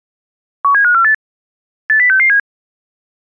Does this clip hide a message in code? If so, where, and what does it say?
Yes: five-tone selective call (CCIR) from 0.6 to 2.4 s, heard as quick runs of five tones, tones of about 100 ms. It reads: 17548 80667